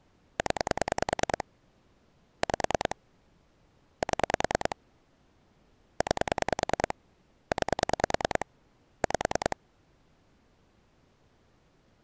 Pulse dialling, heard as clicks on a phone line, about 10 pulses a second. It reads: 0 5 7 9 9 5